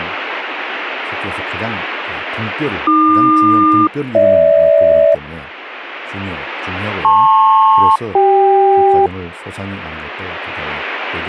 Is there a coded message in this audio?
Yes: aircraft SELCAL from 2.9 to 9.1 s, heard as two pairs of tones, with speech in Korean. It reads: AQ-GH LP-CK